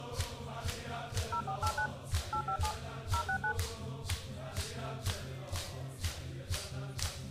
DTMF, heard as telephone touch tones, dialled by machine, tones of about 80 ms. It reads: 0489 857 069